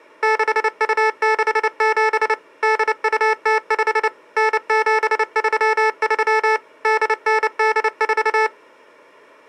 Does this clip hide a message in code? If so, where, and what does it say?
Yes: Morse code (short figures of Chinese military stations) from 0.2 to 8.5 s, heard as electronic beeps, machine-sent, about 29 wpm, 440 Hz. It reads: 6267 8205 9733 8984